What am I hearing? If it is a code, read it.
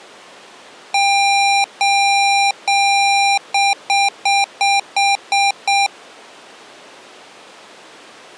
Beep code, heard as beeps from a small speaker, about 800 Hz. 3 long, 7 short.